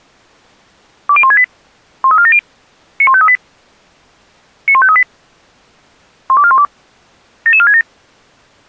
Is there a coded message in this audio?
Yes: five-tone selective call (ZVEI) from 1.1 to 7.8 s, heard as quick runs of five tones, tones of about 70 ms. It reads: 20168 13470 91538 91538 12412 77467